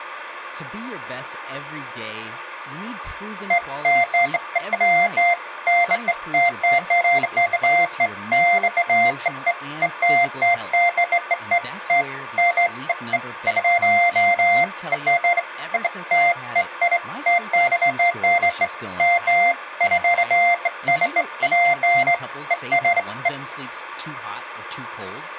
Beeps of irregular length, with hum and speech in English. There is no code.